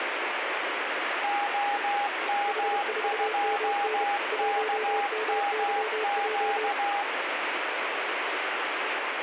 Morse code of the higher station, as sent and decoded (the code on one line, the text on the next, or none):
--- -- ..--- -.- -- --.-
OM2KMQ